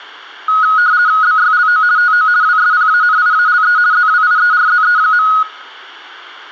RTTY (50 baud, 170 Hz shift), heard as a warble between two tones, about 1360 Hz centre. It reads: BYLO TO WSPANIALE ZWIERZE.